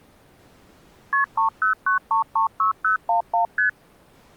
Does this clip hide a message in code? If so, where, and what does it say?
Yes: multi-frequency trunk signalling (R1, as on North American trunks) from 1.1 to 3.7 s, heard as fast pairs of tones, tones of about 120 ms. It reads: KP 309336011 ST